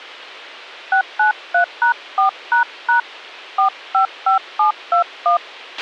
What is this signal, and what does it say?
DTMF, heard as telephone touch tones, dialled by hand, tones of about 120 ms, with a squelch burst at the end. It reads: 693#4## 455721